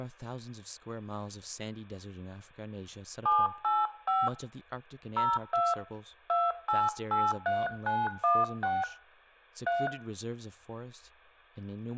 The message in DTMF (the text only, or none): 785 02 2883916 3